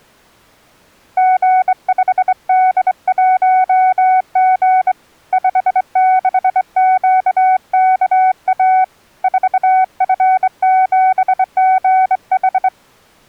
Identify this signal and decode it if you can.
Morse code, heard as a keyed tone, hand-sent with a straight key, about 23 wpm, 750 Hz. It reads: G5D1G 56QKA 4F7GH